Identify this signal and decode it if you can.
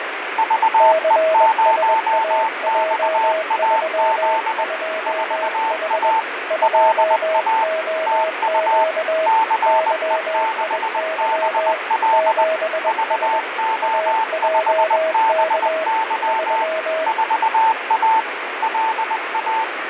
Morse code, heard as two keyed tones, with radio static and fading. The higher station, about 20 wpm, 890 Hz: VE0XAZ 4A LA TU CE6BL VO5BY 4A LA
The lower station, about 21 wpm, 640 Hz: CSAJ32H 2OQ YIY 7S AJK 3